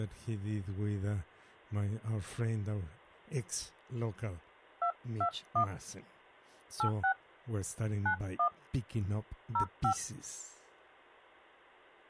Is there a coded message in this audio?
Yes: DTMF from 4.8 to 9.9 s, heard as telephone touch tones, dialled by hand, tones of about 90 ms, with hum. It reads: 221 86 91 05